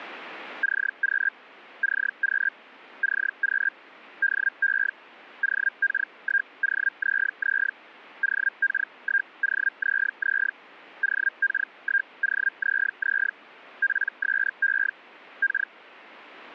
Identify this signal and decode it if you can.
Hellschreiber (Feld-Hell, 122.5 baud), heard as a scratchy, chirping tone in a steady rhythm, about 1600 Hz. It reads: CQ CQ CQ DE OK1OZZ OK1OZZ OK1OZZ PSE K